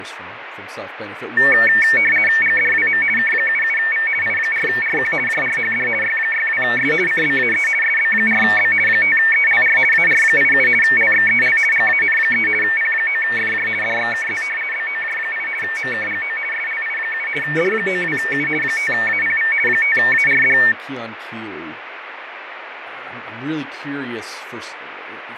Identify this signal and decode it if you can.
RTTY (50 baud, 450 Hz shift), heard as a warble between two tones, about 2000 Hz centre, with radio static, fading and speech in English. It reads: GDWM K77V I4RQ JRHD Y62S CBAE SB4B 5ELR AR87 LXEL GAN3 P9FJ DXKZ BOJ8 MKGO SLI7 D92U 5APV 5ARD